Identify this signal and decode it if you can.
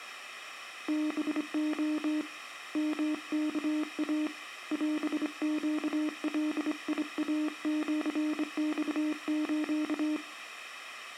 Morse code (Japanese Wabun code), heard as a keyed tone, hand-sent with a straight key, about 25 wpm, 300 Hz. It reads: ハレ ヨワイ オネガイシマス